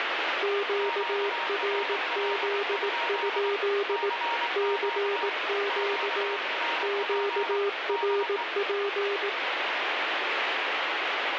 Morse code, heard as two keyed tones, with heavy radio static. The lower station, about 18 wpm, 400 Hz: QRZ? CQ QRP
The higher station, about 23 wpm, 930 Hz: QRL? CQ QRP DE